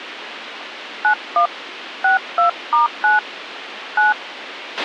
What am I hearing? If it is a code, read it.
DTMF, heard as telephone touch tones, dialled by hand, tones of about 130 ms, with radio hiss and a squelch burst at the end. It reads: 91 62*9 9